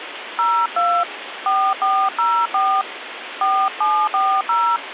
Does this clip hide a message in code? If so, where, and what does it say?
Yes: DTMF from 0.4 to 4.8 s, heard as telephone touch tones, dialled by hand, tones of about 270 ms, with phone line noise. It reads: 02 4404 4740